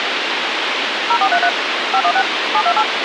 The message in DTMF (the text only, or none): 0433 516 728